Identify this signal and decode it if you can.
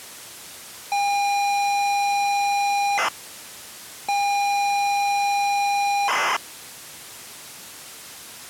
ZX Spectrum tape loading, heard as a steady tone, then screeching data.